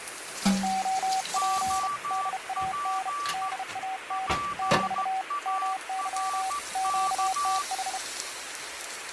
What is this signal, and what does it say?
Morse code, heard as two keyed tones, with radio static and kitchen noise. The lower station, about 32 wpm, 760 Hz: OP DAN DAN - MY QTH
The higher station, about 14 wpm, 1160 Hz: OP PARK